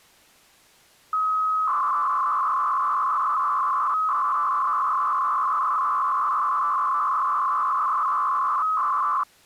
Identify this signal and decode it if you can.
300-baud modem data (Bell 103 tones), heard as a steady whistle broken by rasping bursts, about 300 baud, 200 Hz shift.